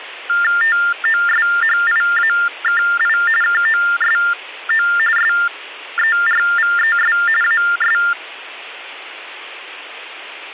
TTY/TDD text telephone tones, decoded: TOSHIAKI KOSO SERVES AS

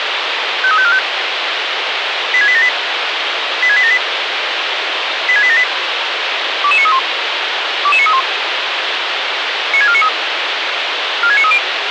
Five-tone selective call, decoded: 53545 86878 86878 86878 22931 22931 96493 46930

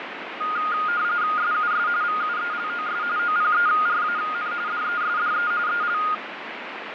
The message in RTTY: SUS VUELOS OPERAN DESDE EL

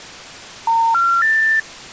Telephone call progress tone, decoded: special information tone

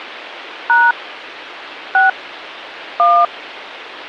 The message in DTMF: # 6 1

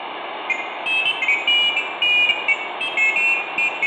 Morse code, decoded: none

